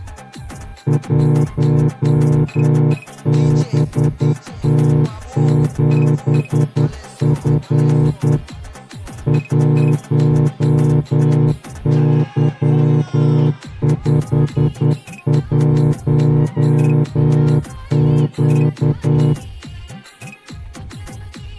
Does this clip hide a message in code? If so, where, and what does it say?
Yes: Morse code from 0.8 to 19.4 s, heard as a horn, hand-sent with a straight key, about 10 wpm. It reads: 1BT7F 1Y51Q